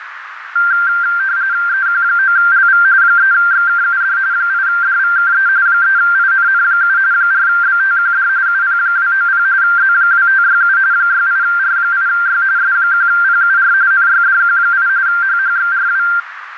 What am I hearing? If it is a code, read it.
RTTY (45.45 baud, 170 Hz shift), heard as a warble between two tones, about 1480 Hz centre, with radio static and a narrow filter. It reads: EQ9LV 3XKUD 8DVKE 3INN7 4BTQD UP290 Z2567 68R8Y S1PUR NYDQ8 HHXRW